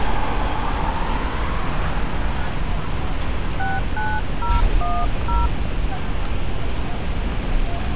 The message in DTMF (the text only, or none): 69010